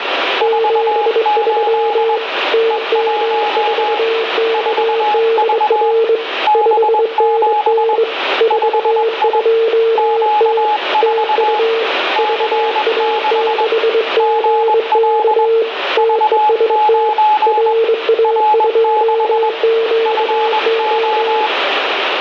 Morse code, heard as two keyed tones, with radio static and room echo. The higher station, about 21 wpm, 840 Hz: 48 E1 4V B7 5I Q4 C6 GL V9 R6 FO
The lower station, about 22 wpm, 450 Hz: 73 TM4KDR 5NN 42T TU VA6GK TEST RA2QO